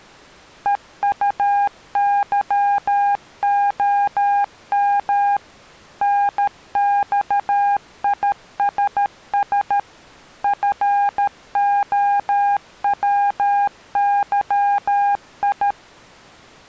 Morse code, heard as a keyed tone, machine-sent, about 13 wpm, 810 Hz. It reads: EUYOM NXISS FOWYI